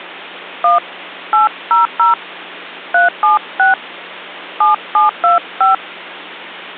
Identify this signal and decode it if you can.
DTMF, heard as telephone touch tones, dialled by hand, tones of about 140 ms, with hum. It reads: 1 800 376 7725